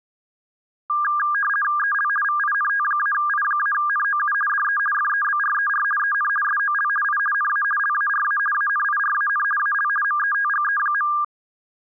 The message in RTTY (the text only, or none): EL VINT-I-NOU DE FEBRER EN SOL I NA LARA ANIRAN AL METGE.